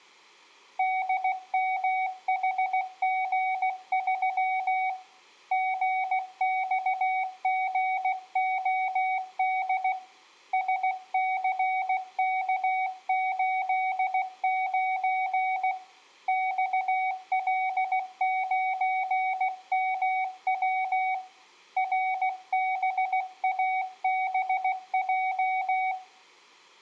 Morse code, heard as a keyed tone, hand-sent with a paddle, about 16 wpm, 750 Hz, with room echo. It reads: DMHG3 GXGOD SCK89 XL9MW RBABJ